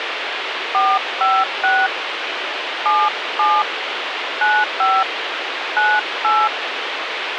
DTMF, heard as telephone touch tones, dialled by hand, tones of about 230 ms, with radio hiss. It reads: 456 77 95 98